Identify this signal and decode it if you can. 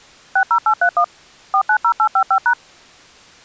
DTMF, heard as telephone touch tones, dialled by machine, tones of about 80 ms. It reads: 60831 490855#